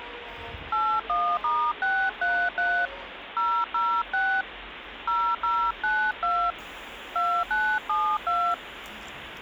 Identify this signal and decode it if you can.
DTMF, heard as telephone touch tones, dialled by hand, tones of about 280 ms, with phone line noise and the noise of a subway station. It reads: 81*633 006 0092 2972